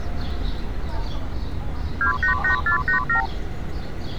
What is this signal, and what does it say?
Multi-frequency trunk signalling (R2, with the far end's replies), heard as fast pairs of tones, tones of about 110 ms, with street noise. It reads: 288487